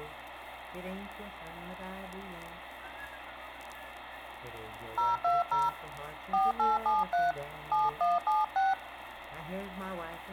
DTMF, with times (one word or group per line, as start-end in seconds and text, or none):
5.0-5.7 020
6.3-7.3 4873
7.7-8.7 7176